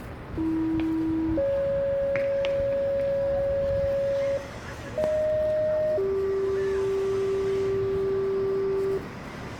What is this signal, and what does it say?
Two-tone page, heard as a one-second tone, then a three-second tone, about 320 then 550 Hz, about 620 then 390 Hz, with radio hiss, room echo and street noise.